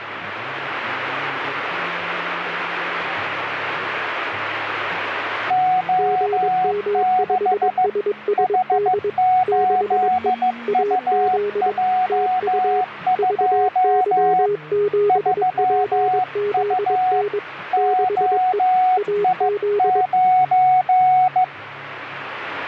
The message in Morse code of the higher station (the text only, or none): O6 H8UJ2 3U OI9